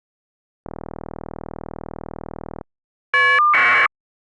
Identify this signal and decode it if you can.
Caller ID data burst, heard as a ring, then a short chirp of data, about 1200 baud.